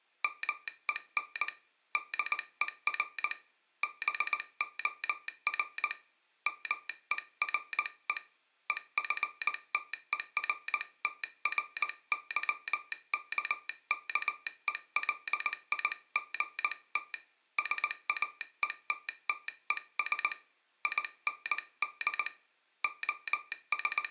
Morse code, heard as a telegraph sounder, hand-sent with a paddle, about 19 wpm. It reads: MEN DER BOR MERE EFTERTRYKKELIGT SAETTES IND …